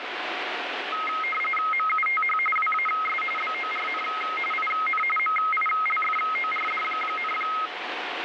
RTTY (45.45 baud, 850 Hz shift), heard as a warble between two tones, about 1700 Hz centre, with radio static. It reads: MUTH WAS BORN IN MILFORD,